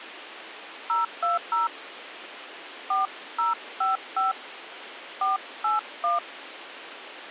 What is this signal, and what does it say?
DTMF, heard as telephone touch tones, dialled by hand, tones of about 150 ms, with radio hiss. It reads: 020 4055 481